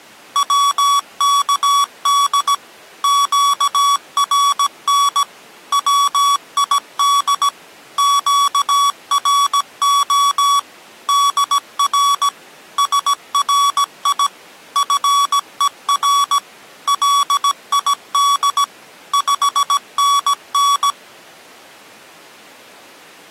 Morse code, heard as electronic beeps, machine-sent, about 17 wpm, 1130 Hz. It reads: WKD QRN WID QRO DR SRI FER LID 5NN